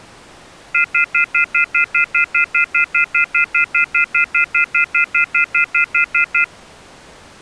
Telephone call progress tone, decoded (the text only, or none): off-hook warning tone